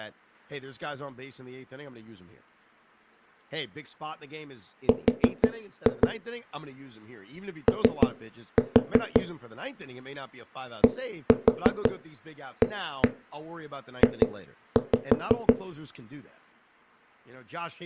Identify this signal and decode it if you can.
Tap code, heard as knocks on a wall, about 6 knocks a second, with speech in English. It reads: R O DAJ